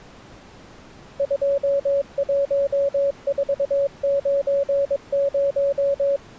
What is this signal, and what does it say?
Morse code, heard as a keyed tone, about 22 wpm, 560 Hz. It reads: 21490